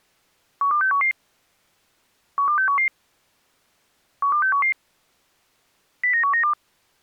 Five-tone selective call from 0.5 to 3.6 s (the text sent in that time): 12611 12611